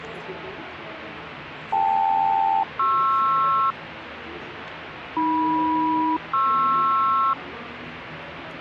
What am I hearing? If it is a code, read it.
Aircraft SELCAL, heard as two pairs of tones, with radio static and the noise of a cafe. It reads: KL-PR AM-PR